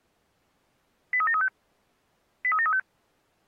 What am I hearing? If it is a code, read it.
Five-tone selective call (ZVEI), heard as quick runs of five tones, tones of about 70 ms. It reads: 83735 83735